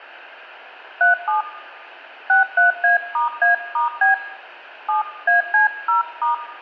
DTMF, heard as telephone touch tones, dialled by hand, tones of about 130 ms, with room echo. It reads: 37 63A*A*B 7AC0*